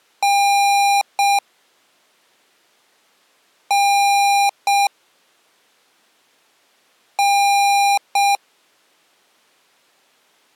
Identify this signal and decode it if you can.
Beep code, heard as beeps from a small speaker, played three times, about 800 Hz. 1 long, 1 short. In IBM BIOS tables: system board problem.